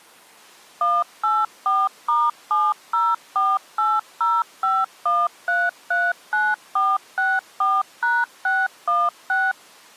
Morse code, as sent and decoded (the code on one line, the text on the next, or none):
none